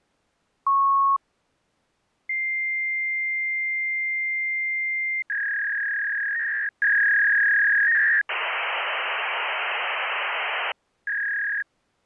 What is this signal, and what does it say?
Fax machine handshake, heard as a beep, a long tone, a warble and hiss.